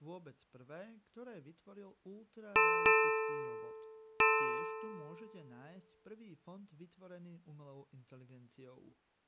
Ship's bell, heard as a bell, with speech in Slovak. 3. Three half-hours of the watch have passed.